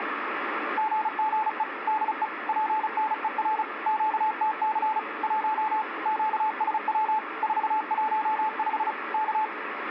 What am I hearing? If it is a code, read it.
Morse code, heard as a keyed tone, machine-sent, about 35 wpm, 870 Hz, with radio static. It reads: GGE DE PNER QTC 1 QSW 415 K